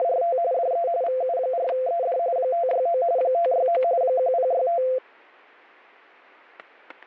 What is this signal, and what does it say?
RTTY (45.45 baud, 170 Hz shift), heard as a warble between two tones, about 600 Hz centre, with static crashes. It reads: … DE VU4ED 569 569 1065